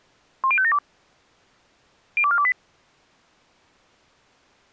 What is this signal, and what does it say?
Five-tone selective call (ZVEI), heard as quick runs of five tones, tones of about 70 ms. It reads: 10572 02428